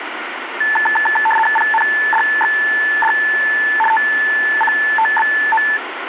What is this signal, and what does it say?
RTTY (75 baud, 850 Hz shift), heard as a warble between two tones, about 1310 Hz centre, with radio static. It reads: PNDXD TCTBO